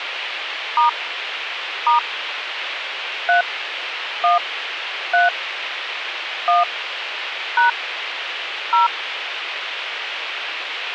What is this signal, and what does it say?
DTMF, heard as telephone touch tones, dialled by hand, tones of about 150 ms, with radio hiss. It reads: * * 3 1 3 1 # 0